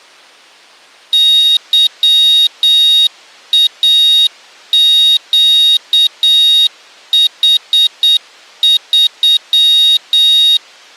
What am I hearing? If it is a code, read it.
Morse code, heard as a high beeper, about 8 wpm, 3750 Hz. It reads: YAQH3